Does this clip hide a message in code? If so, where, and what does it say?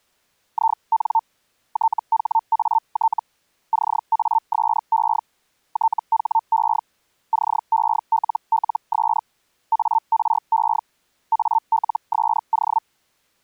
Yes: Hellschreiber (Feld-Hell, 122.5 baud) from 0.5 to 12.8 s, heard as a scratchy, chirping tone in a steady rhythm, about 900 Hz. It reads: IN THAT CASE THE CELLS ARE ALSO